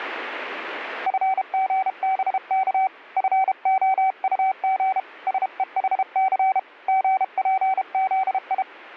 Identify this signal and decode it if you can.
Morse code, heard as a keyed tone, hand-sent with a paddle, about 32 wpm, 760 Hz. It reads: FGBK FOUG SEHC GPZI